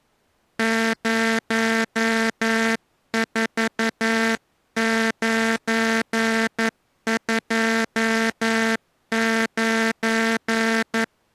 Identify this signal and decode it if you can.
Morse code, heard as a buzzer, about 11 wpm. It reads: 04929